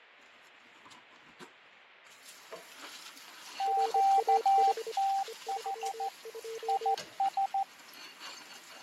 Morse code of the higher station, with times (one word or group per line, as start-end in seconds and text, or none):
3.6-6.1 QTH
6.7-7.6 IS